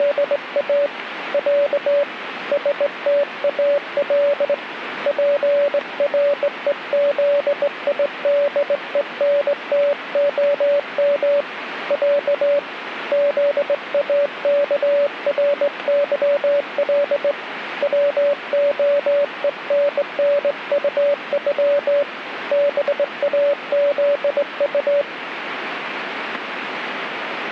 Morse code (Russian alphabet), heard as a keyed tone, hand-sent with a straight key, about 20 wpm, 570 Hz, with radio static. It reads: … Я СТАЛ ПРЕЗИДЕНТОМ Я ЗАКРЫЛ ВОЕННУЮ БАЗУ